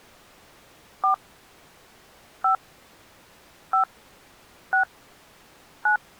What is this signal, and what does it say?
DTMF, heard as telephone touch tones, dialled by hand, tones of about 110 ms. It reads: 4 5 5 6 9